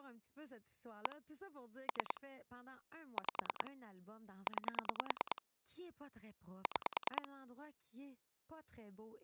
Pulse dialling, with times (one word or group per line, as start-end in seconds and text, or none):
1.1-1.2 1
1.9-2.2 3
3.2-3.7 5
4.5-5.4 9
6.7-7.3 6